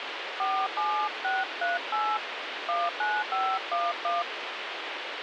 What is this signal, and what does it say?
DTMF, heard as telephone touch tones, dialled by hand, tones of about 230 ms, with radio hiss. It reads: 47638 19511